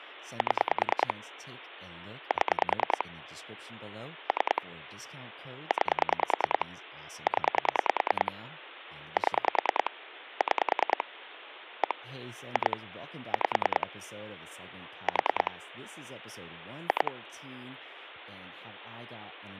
Pulse dialling, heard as clicks on a phone line, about 10 pulses a second, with phone line noise and speech in English. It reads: 7 7 3 9 0 7 6 1 2 5 4 2